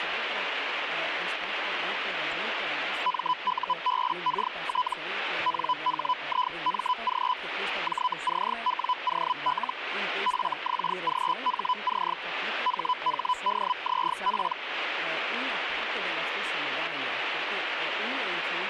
Hellschreiber (Feld-Hell, 122.5 baud), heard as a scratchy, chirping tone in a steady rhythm, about 1000 Hz, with radio static. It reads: MUBKT NHIMG JCWOL FXGHC HHDZP